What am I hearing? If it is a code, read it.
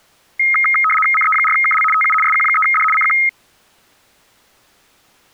RTTY (75 baud, 850 Hz shift), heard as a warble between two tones, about 1700 Hz centre. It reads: CE4KL TU SQ3D CQ